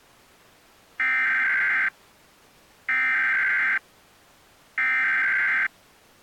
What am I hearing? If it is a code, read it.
Emergency Alert System (SAME) tones (header bursts), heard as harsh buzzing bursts, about 520.83 baud.